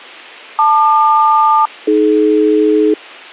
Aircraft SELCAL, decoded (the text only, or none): LQ-AD